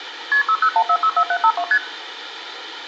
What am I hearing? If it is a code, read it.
Multi-frequency trunk signalling (R1, as on North American trunks), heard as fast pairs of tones, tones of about 70 ms, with phone line noise and room echo. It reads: KP 601464752 ST